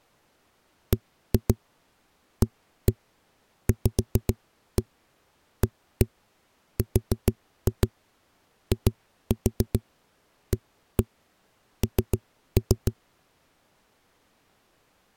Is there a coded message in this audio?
Yes: tap code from 0.9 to 13.0 s, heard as knocks on a wall, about 7 knocks a second. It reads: BAVARIAN